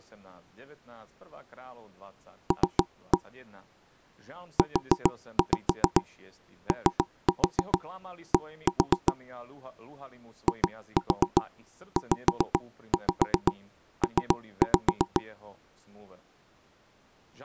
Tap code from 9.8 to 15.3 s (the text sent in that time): IZP